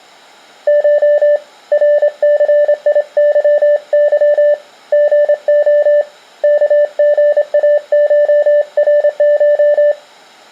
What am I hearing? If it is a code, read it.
Morse code (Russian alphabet), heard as a keyed tone, hand-sent with a straight key, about 26 wpm, 590 Hz. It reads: Ш РЦИЫЫ ГО КГАШРШ